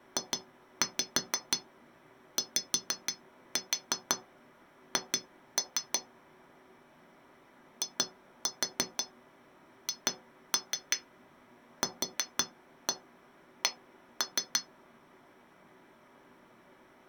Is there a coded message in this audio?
Yes: tap code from 0.2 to 14.7 s, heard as taps on glass, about 6 knocks a second. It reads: JYH IHQC